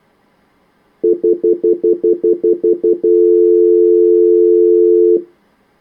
Telephone call progress tone (North American plan), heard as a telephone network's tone, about 350, 440 Hz, 0.1 s on and 0.1 s off. Stutter dial tone.